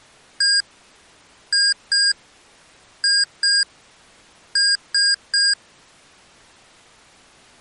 Beep code, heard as beeps from a small speaker, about 1600 Hz. 1-2-2-3. In Phoenix BIOS tables: BIOS ROM checksum failure.